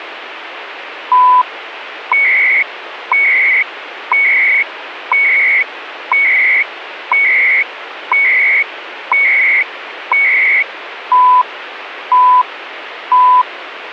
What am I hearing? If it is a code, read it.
Radio time signal (CHU, Canada), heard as beeps and data bursts, one a second, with radio static.